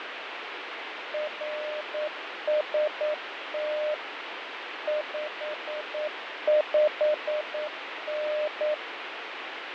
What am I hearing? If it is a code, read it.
Morse code, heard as a keyed tone, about 9 wpm, 600 Hz, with radio static and fading. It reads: RST 55N